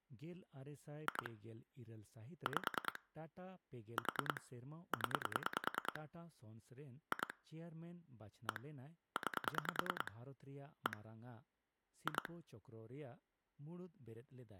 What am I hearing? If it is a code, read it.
Pulse dialling, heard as clicks on a phone line, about 10 pulses a second, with speech in Santali. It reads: 2 5 4 0 2 1 9 1 2